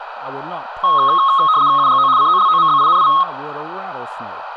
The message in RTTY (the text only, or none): UGO COLOMBINI